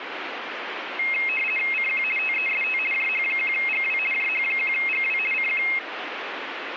RTTY (50 baud, 450 Hz shift), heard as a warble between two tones, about 2350 Hz centre, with radio static. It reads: CQ TEST JH1GW JH1GW CQ